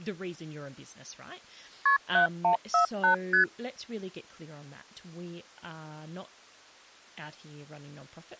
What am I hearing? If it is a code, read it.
Multi-frequency trunk signalling (R1, as on North American trunks), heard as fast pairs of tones, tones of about 110 ms, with speech in English. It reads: KP 7148 ST